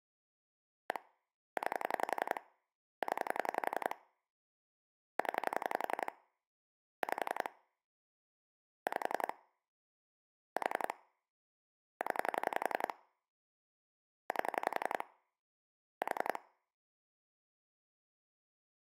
Pulse dialling, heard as clicks on a phone line, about 11 pulses a second. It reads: 1 9 0 0 5 5 4 0 8 4